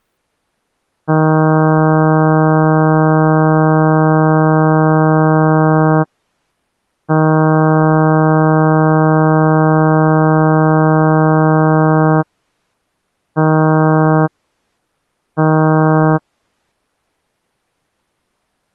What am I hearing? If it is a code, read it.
Ship horn signal, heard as a ship's horn, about 160 Hz. 2 long, 2 short. At sea: I intend to overtake on your port side.